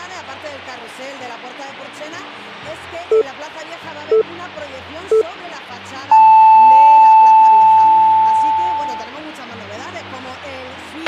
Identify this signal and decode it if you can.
Radio time signal (three low pips and a long one an octave up, as on NHK), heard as pips, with a squelch burst at the end.